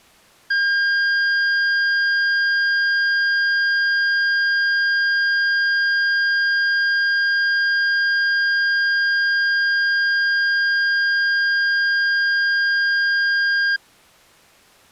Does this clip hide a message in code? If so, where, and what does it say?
No, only a steady tone.